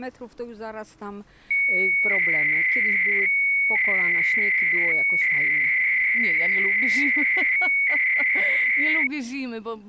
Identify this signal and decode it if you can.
300-baud modem data (Bell 103 tones), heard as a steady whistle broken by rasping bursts, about 300 baud, 200 Hz shift.